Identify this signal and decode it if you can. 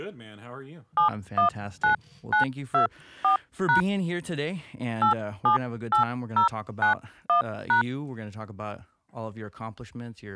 DTMF, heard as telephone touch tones, dialled by hand, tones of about 110 ms, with speech in English. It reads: 719924# 878091#